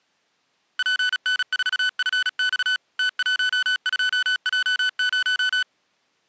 Morse code, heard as electronic beeps, machine-sent, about 36 wpm, 1500 Hz. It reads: PN4FX T12J0